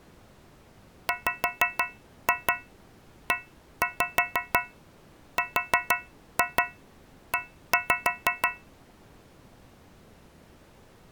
Tap code, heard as taps on a metal pipe, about 6 knocks a second. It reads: WERE